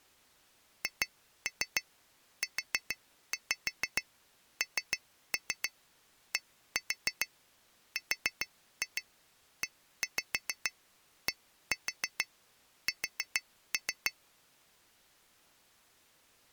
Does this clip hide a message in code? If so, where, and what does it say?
Yes: tap code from 0.8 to 14.2 s, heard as taps on glass, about 6 knocks a second. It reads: HUNDREDS